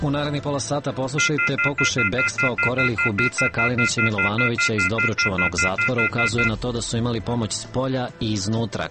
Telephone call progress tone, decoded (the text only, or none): off-hook warning tone